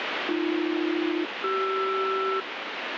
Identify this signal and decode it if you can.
Aircraft SELCAL, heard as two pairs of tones, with radio static. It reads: AB-CR